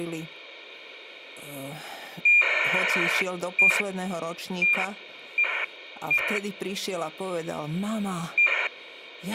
ACARS aircraft data, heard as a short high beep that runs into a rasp, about 2400 baud, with radio hiss, a squelch burst at the end and speech in Slovak.